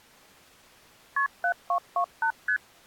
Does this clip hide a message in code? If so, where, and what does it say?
Yes: multi-frequency trunk signalling (R1, as on North American trunks) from 1.2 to 2.6 s, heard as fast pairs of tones, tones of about 80 ms. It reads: KP 7228 ST